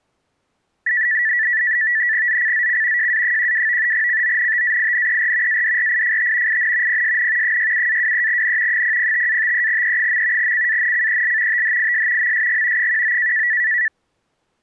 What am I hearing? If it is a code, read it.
NAVTEX (SITOR-B), 100 baud, 170 Hz shift, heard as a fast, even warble, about 1850 Hz centre. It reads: ZCZC JA12 CONTAINER ADRIFT IN PSN 67-23N 005-53E. CANCEL THIS MSG 19